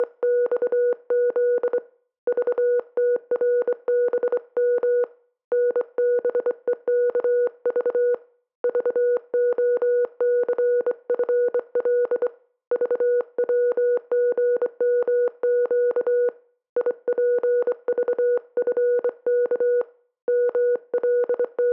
Morse code, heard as a keyed tone, hand-sent with a straight key, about 24 wpm, 490 Hz. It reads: … VTRBM NBEKV VOCFL VWGMQ IPVFK …